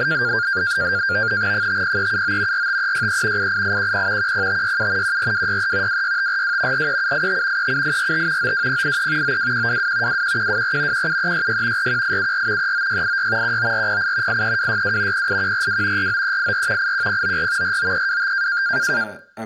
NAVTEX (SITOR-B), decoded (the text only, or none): 50379 45363 88810 10567 14263 26542 43785 37845 92083 92122 21124 17366 41874 39686 19408 83262 08142 49384 81094 49325